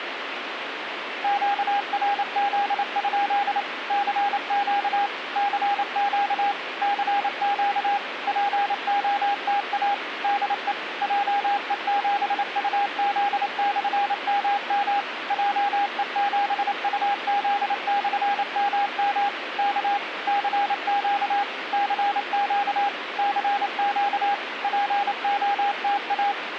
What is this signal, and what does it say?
Morse code, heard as a keyed tone, machine-sent, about 28 wpm, 810 Hz, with radio static. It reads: QRZ? CQ CQ CQ POTA DE JE7UZ/MM JE7UZ/MM K CQ CQ CQ POTA